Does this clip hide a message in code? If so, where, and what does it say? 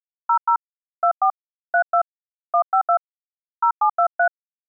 Yes: DTMF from 0.3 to 4.3 s, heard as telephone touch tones, dialled by hand, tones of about 90 ms. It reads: 00 24 32 152 0723